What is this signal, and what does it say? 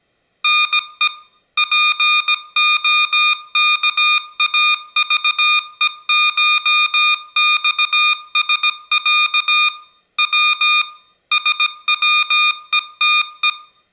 Morse code (Russian alphabet), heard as electronic beeps, machine-sent, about 17 wpm, 1220 Hz, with room echo. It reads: НЕ ПОКАЖЕШЬСЯ В СВЕТЕ